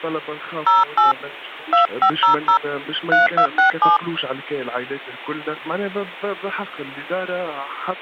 DTMF, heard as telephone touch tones, dialled by hand, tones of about 130 ms. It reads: 08 2500 3267